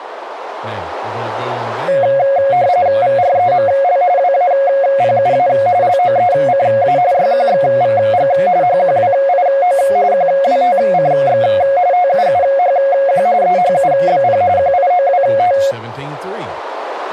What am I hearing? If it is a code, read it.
RTTY (45.45 baud, 170 Hz shift), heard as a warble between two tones, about 630 Hz centre, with radio static and speech in English. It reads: VREML WAPUA LOECA YQXVG HQWIO QWTCX TUUHQ EHUBP QIOWT